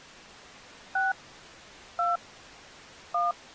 DTMF, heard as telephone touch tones, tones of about 170 ms. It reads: 6 2 1